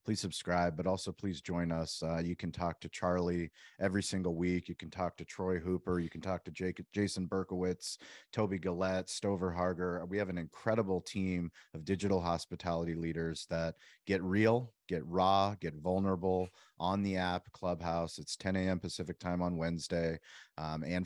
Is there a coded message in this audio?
No, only speech in English.